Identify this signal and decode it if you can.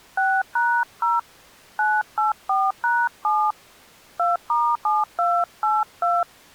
DTMF, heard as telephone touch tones, dialled by hand, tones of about 210 ms. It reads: 6#0 984#7 2*7282